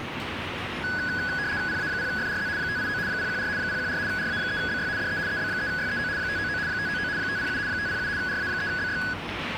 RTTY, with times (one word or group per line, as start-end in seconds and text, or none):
1.7-2.5 PA0FRZ
2.6-3.0 589
3.1-3.5 014
3.6-4.0 014
4.1-4.9 RA3BY
5.0-5.2 DE
5.3-6.1 EB3YEO
6.2-6.6 599
6.7-7.1 599
7.2-7.6 507
7.7-8.1 507
8.2-9.0 RA3BY